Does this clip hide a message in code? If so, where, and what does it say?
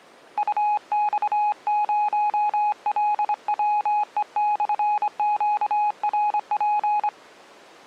Yes: Morse code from 0.3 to 7.1 s, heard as a keyed tone, hand-sent with a straight key, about 25 wpm, 840 Hz. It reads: UX0LWE/QRP